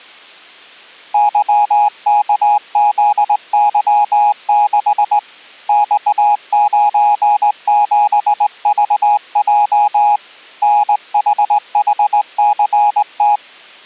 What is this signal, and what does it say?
Morse code, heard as a keyed tone, hand-sent with a straight key, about 19 wpm, 830 Hz. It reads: YKZY6 X97VJ NHHCT